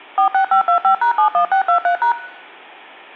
DTMF, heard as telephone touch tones, dialled by machine, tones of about 100 ms. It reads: 46525#71623#